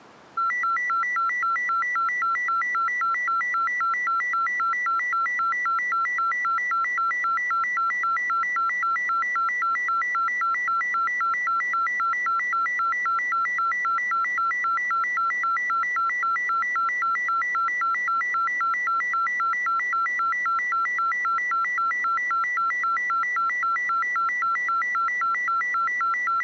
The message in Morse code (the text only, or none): none